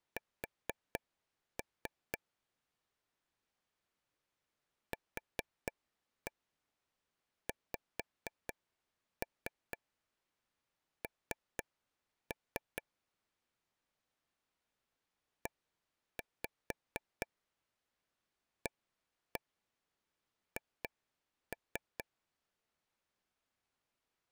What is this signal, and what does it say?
Tap code, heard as taps on a table, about 4 knocks a second. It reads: S QXN EAH